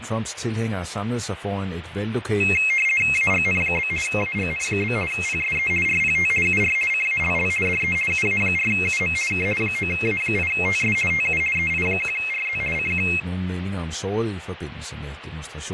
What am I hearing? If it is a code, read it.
RTTY (50 baud, 450 Hz shift), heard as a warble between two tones, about 2350 Hz centre, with radio static, fading and speech in Danish. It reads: AGN? AGN? PSE RPT UR CALL DE UA4UM K 9A8TS TU EI1RZ CQ